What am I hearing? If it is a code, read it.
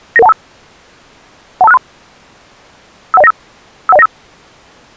Five-tone selective call (EIA), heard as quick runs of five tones, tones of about 30 ms. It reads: 99125 12563 51095 51095